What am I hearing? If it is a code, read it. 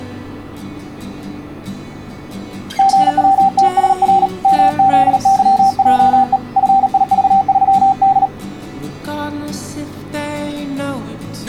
Morse code, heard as a keyed tone, hand-sent with a paddle, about 38 wpm, 780 Hz. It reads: GWTSR MZYJE FIV3D